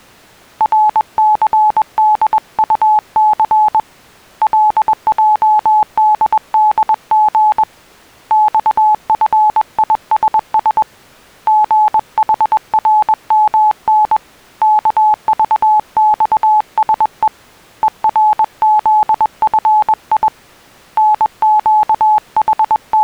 Morse code, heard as a keyed tone, hand-sent with a paddle, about 21 wpm, 850 Hz. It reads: RCDUC LJDDG XFISS GHRMN KVXSE ERZFI …